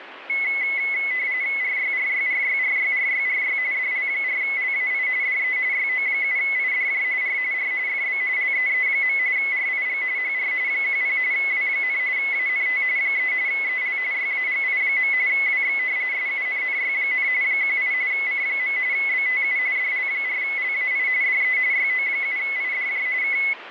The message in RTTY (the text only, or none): RYRYRYRYRYRY DL4LAI DE YO7IDJ R R FB LEE. RIG HR 10 W, ANT 3 EL YAGI. WX SUNNY, 18 C. BTU DL4LAI DE YO7IDJ K